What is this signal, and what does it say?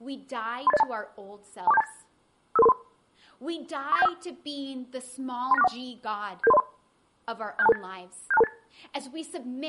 Five-tone selective call (EIA), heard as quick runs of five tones, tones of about 30 ms, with speech in English. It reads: 38082 24728 55333 49715 39641 77303 76228 76228